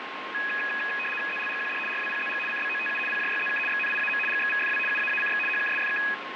RTTY (75 baud, 850 Hz shift), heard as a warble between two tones, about 2100 Hz centre, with radio static and a steady whistle near 1070 Hz. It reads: ZLGQD RWPZG CBOTU PJYZK XNIAM GXVFW UAACX HKSFK